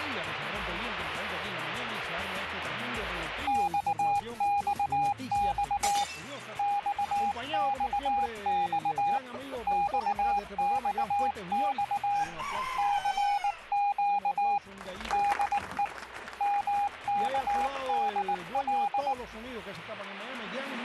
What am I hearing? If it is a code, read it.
Morse code, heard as a keyed tone, hand-sent with a paddle, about 19 wpm, 810 Hz. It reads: XXX XXX XXX CQ DE MKDL